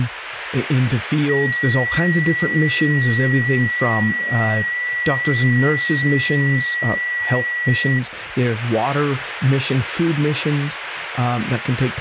FT8 (one signal), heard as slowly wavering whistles, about 6.25 baud, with radio static and speech in English.